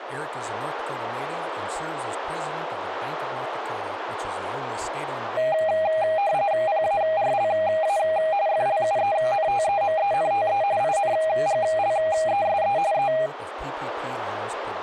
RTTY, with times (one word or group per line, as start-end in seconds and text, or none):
6.7-8.0 PARLA
8.5-10.6 FLUENTEMENTE
10.8-12.8 INGLESE
12.9-13.1 E